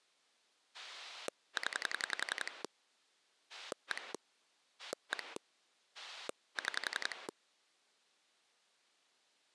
Pulse dialling, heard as a rotary dial, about 11 pulses a second. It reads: 0 1 1 6